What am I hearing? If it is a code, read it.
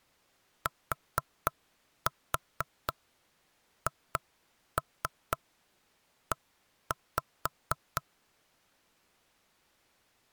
Tap code, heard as knocks on wood, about 4 knocks a second. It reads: THE